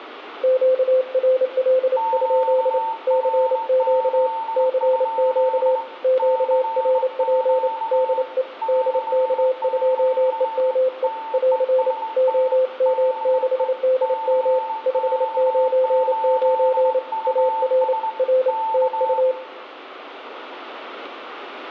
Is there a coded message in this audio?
Yes: Morse code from 0.4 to 19.4 s, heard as two keyed tones, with room echo. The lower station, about 28 wpm, 520 Hz: QRL? CQ CQ QRP DE DK2EME <AR> OM6DM 599 AR R TU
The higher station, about 20 wpm, 890 Hz: QRZ? CQ CQ TEST DE CX8US K